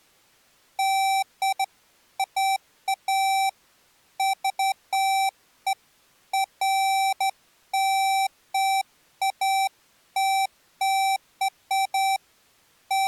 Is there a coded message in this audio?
No, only beeps of irregular length.